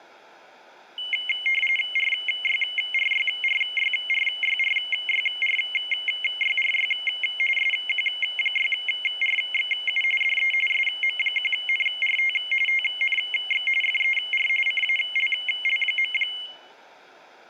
RTTY (45.45 baud, 850 Hz shift), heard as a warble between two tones, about 2550 Hz centre. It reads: RYRYRYRYRYRYRY SQ6RXU DE SM1NRT TNX FER CALL.